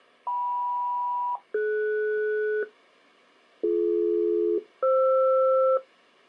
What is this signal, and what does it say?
Aircraft SELCAL, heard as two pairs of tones. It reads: KM-DS BD-FR